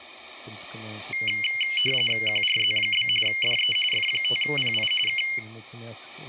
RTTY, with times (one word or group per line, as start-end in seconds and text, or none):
2.3-3.1 QRZ?
3.3-3.8 DE
3.9-4.9 F5PI
5.1-5.2 K